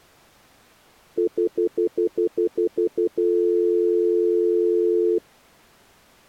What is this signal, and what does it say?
Telephone call progress tone (North American plan), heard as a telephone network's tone, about 350, 440 Hz, 0.1 s on and 0.1 s off. Stutter dial tone.